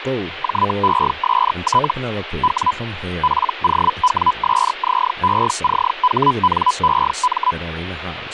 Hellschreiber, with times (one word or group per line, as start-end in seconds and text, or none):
0.4-1.9 JEST
2.4-2.7 W
3.2-7.5 POWSZECHNEM